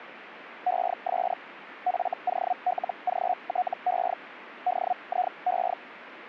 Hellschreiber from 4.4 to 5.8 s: DIE

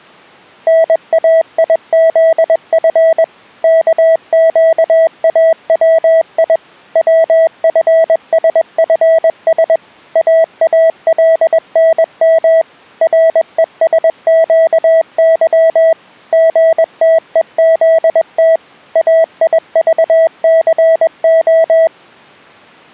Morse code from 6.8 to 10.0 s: WFSFS

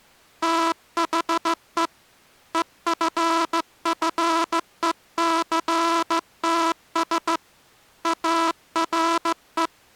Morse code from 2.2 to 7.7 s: EFFECTS

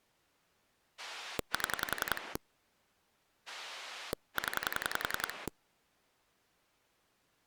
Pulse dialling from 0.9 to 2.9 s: 7

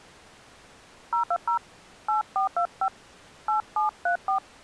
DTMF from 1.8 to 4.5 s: 8425 8734

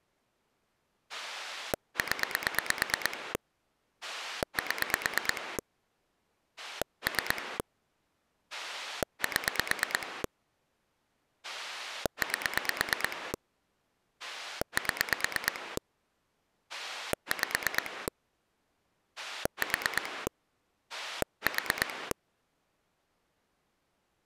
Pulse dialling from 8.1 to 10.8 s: 7

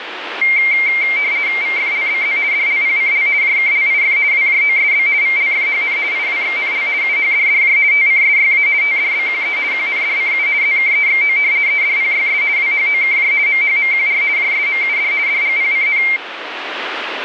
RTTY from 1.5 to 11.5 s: VFLBZ DLPCL JKLIF WJOSB VLFHN IWXNL UHDDJ TCSYA TDBQE QNDCU ZKEXO

